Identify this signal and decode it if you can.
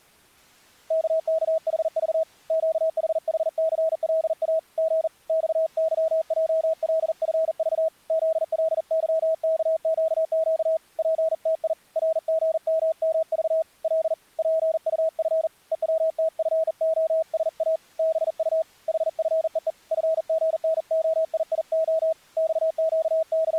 Morse code, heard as a keyed tone, hand-sent with a bug key, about 40 wpm, 640 Hz. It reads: KKHV QHHCLA G XYJLFV ZLYKQQ PTI RGMMV L PUF EWTFOSA BU HFEE FGNOIIO …